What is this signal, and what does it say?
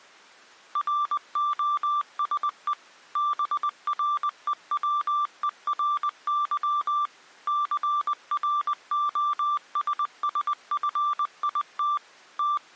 Morse code, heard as a keyed tone, machine-sent, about 20 wpm, 1180 Hz. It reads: ROSE BREWERY CROSSFIT …